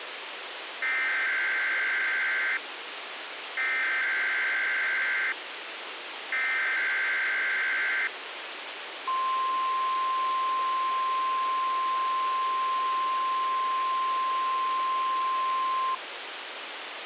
Emergency Alert System (SAME) tones (header bursts, then the 1050 Hz attention tone), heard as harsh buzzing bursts, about 520.83 baud, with radio hiss.